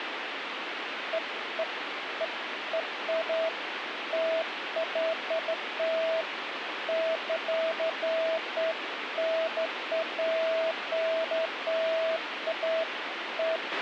Beeps of irregular length, with radio hiss and a squelch burst at the end. There is no code.